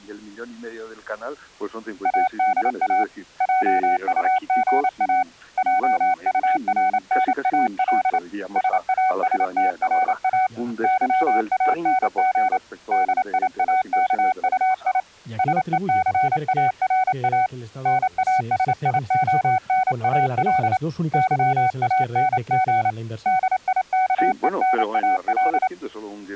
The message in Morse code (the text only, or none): ADA JUGA JURNAL SASTRA YANG DIAKUI SECARA NASIONAL YANG DIKENAL